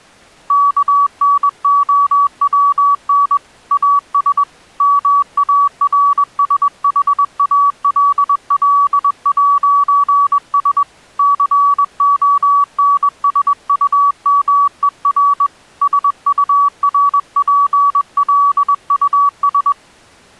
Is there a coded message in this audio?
Yes: Morse code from 0.4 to 19.8 s, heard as a keyed tone, hand-sent with a bug key, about 21 wpm, 1140 Hz. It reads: KNOWN AS MARSHALL'S CONSUMER SURPLUS